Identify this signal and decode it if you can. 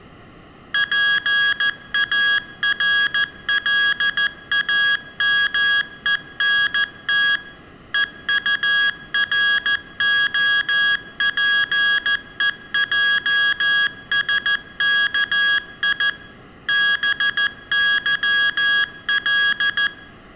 Morse code, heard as electronic beeps, machine-sent, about 14 wpm, 1650 Hz, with room echo. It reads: PARLAMENT EUROPEJSKI BYL